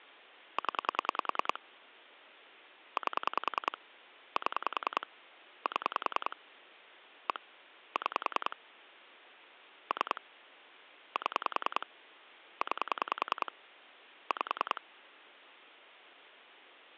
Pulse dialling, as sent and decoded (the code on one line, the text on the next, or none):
10 / 8 / 7 / 7 / 1 / 6 / 3 / 7 / 9 / 5
0 8 7 7 1 6 3 7 9 5